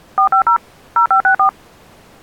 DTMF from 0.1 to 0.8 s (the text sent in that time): 450